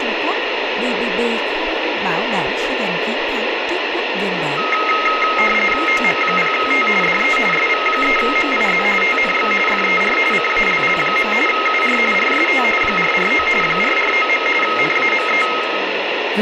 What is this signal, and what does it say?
RTTY (45.45 baud, 850 Hz shift), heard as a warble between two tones, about 1700 Hz centre, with radio static and speech in Vietnamese. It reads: OM0T DE SV3MIZ TNX FER CALL. UR RST 449 449. NAME